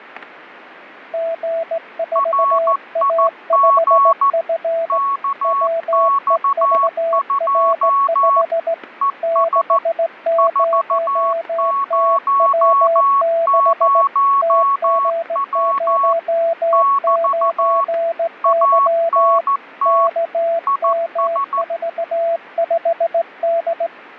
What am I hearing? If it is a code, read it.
Morse code, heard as two keyed tones, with static crashes. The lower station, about 17 wpm, 670 Hz: G4A5F WEVR5 60TW6 TG09Y KM45D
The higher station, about 14 wpm, 1110 Hz: RIG KX2 ES 400W <BT> ANT IS